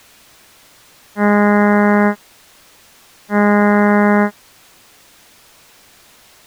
Ship horn signal, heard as a ship's horn, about 210 Hz. 2 short. At sea: I am altering course to port.